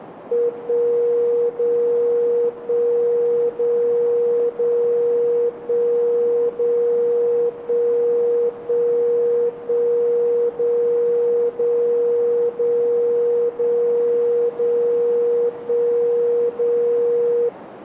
Radio time signal (DCF77), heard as a tone whose level steps once a second, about 480 Hz, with radio static. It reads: 1 0 1 0 0 1 0 1 1 1 0 0 0 0 0 1 0